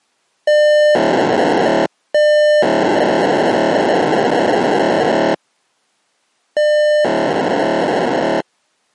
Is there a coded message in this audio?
Yes: POCSAG pager data (1200 baud) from 0.5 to 8.4 s, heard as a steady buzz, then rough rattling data.